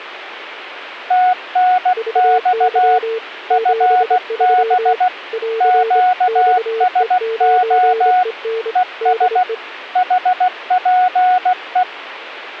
Morse code, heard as two keyed tones. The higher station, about 16 wpm, 730 Hz: TNX FB QSO ES HPE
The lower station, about 25 wpm, 450 Hz: VY 73 <AR> XE9EN DE